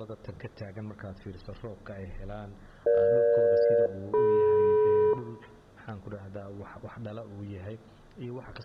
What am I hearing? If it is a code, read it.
Aircraft SELCAL, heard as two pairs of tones, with room echo. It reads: EG-DM